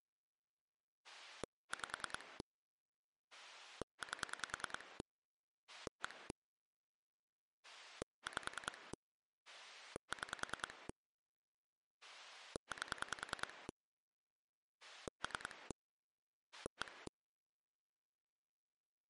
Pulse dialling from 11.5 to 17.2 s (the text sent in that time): 8 3 1